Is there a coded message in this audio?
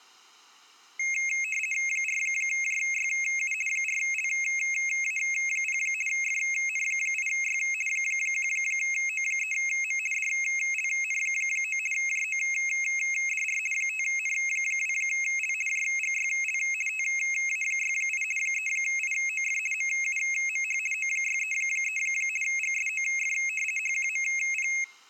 Yes: RTTY (50 baud, 450 Hz shift) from 1.0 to 24.8 s, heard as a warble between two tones, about 2350 Hz centre. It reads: 4JYU 4LA0 FN8Y 1O3M DLN9 JODR 5N2L JGYL TA68 3IOF MUMH O633 GSOF HQMP